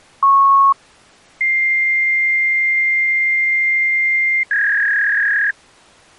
Fax machine handshake, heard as a beep, a long tone and a warble.